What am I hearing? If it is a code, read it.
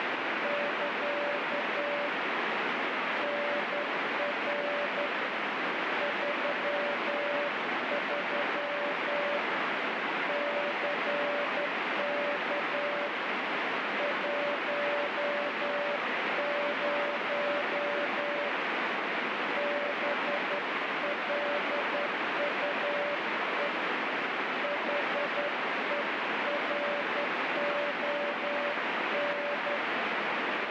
Morse code, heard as a keyed tone, hand-sent with a straight key, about 11 wpm, 580 Hz, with heavy radio static. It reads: <KA> NR 33 CK 10 BLUE HERON